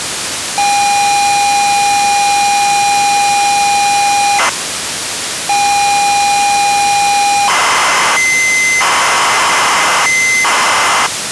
ZX Spectrum tape loading, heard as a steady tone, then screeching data, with tape hiss.